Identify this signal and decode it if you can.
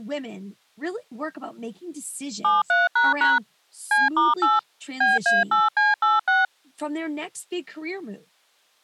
DTMF, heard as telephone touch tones, dialled by machine, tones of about 180 ms. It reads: 73## C*8 BA8C86